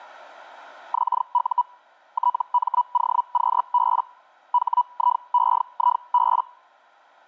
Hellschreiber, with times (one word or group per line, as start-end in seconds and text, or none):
0.9-1.6 XU
2.1-4.0 TMOQB
4.5-6.4 HIEIB